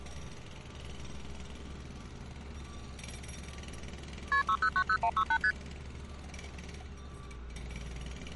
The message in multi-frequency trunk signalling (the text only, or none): KP 6090168 ST